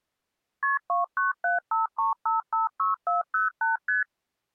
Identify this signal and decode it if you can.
Multi-frequency trunk signalling (R1, as on North American trunks), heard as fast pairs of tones, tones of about 150 ms. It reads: KP 29753556408 ST